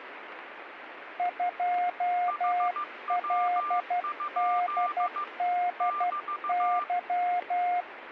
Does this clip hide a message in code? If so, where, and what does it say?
Yes: Morse code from 1.1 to 7.9 s, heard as two keyed tones, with radio static. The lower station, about 12 wpm, 710 Hz: 2LDDY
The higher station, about 15 wpm, 1190 Hz: HW? <BT>